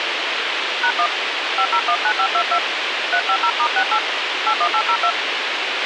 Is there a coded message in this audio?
Yes: DTMF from 0.8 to 5.1 s, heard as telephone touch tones, dialled by hand, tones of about 70 ms, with radio hiss and a squelch burst at the end. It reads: #1 5019522 350*68 81802